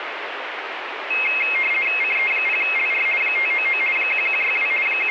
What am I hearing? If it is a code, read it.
RTTY (50 baud, 450 Hz shift), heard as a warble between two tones, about 2350 Hz centre, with radio static. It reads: CE0LR 599 1162 …